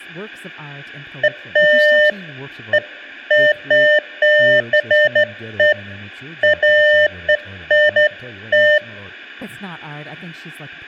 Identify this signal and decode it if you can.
Beeps of irregular length, with room echo and speech in English. There is no code.